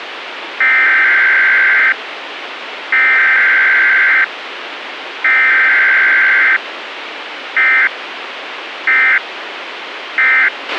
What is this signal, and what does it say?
Emergency Alert System (SAME) tones (header bursts, then end-of-message bursts), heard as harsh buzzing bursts, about 520.83 baud, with radio hiss and a squelch burst at the end.